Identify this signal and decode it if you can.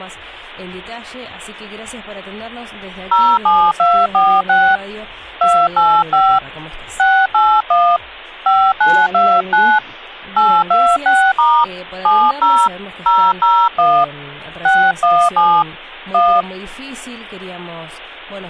DTMF, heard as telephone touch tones, dialled by hand, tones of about 260 ms. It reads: 07246 285 681 5929 826* 70 001 617 1